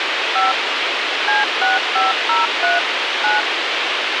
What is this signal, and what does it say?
DTMF, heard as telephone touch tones, dialled by machine, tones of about 160 ms, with radio hiss. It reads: 5 C6503 9